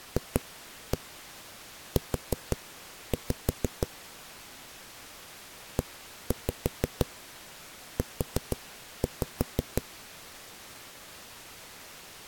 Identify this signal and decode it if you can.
Tap code, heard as knocks on a wall, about 5 knocks a second. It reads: FU EU